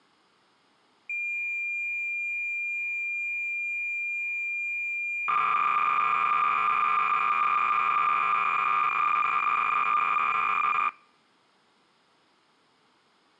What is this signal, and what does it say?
Cassette data (Kansas City type), 300 baud, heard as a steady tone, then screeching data.